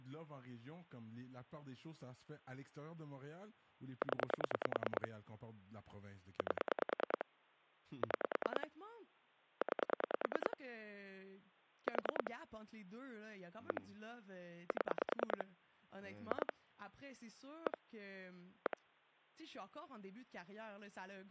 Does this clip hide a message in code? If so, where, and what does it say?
Yes: pulse dialling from 4.0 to 18.7 s, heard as clicks on a phone line, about 10 pulses a second, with speech in French. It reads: 0 8 6 9 4 1 7 2 1 1